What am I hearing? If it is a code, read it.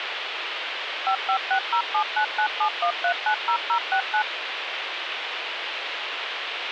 DTMF, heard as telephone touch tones, dialled by machine, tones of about 90 ms, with phone line noise. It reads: 556079971390069